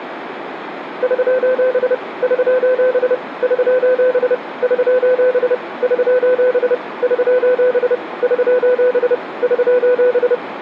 Morse code, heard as a keyed tone, machine-sent, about 30 wpm, 500 Hz, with radio static, a narrow filter and room echo. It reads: <SOS> <SOS> <SOS> <SOS> <SOS> <SOS> <SOS> <SOS>